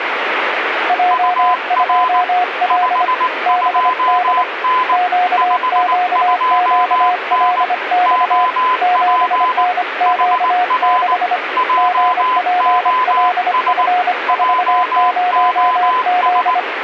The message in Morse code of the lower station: J2L BD QQQLX 7NQ6 GPLF40Z

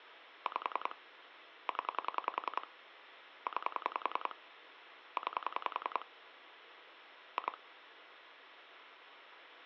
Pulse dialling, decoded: 5 0 9 9 2

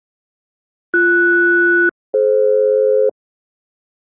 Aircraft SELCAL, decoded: BS-DF

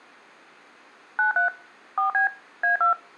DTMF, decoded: 93 4B A2

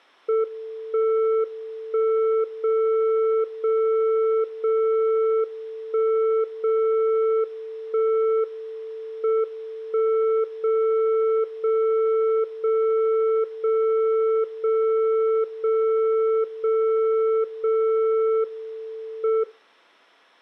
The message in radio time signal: 1 1 0 0 0 1 0 1 M 1 0 0 0 0 0 0 0 0 M

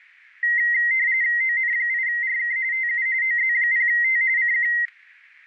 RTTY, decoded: ON8RK TU OZ0T CQ

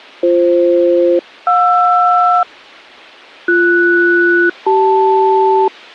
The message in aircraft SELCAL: BF-JR BS-CL

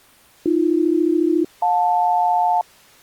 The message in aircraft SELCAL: AB-JL

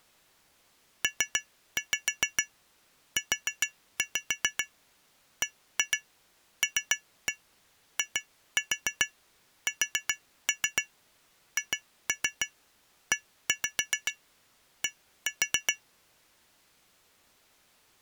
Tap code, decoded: PUBLISHED

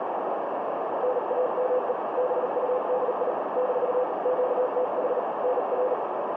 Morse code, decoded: NAME BUDI - QTH NR

